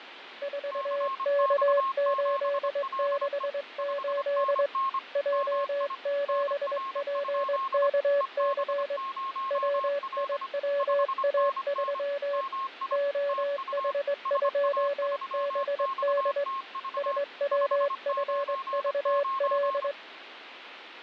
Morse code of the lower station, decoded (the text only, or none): 4K868 J7PKC WIWA3 OH2BD SWFVL